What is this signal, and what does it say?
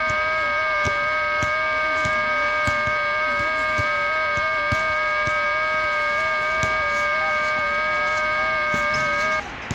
FT8 (several signals at once), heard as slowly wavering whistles, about 6.25 baud, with radio static and the noise of a residential street.